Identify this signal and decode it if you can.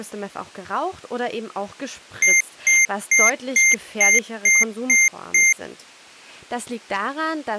Beep code, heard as beeps from a small speaker, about 2100 Hz, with speech in German. 8 short. In AMI BIOS tables: display memory failure; in Dell tables: LCD failure.